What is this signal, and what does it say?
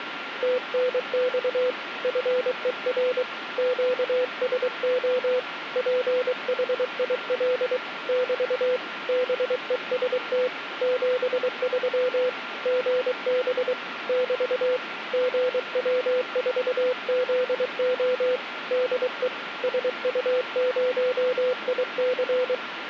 Morse code, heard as a keyed tone, hand-sent with a paddle, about 23 wpm, 500 Hz, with radio static and a steady whistle near 1380 Hz. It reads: TNX FER QSO PHIL <BT> BEST 73 GB <BT> GW4ZO DE SU0IC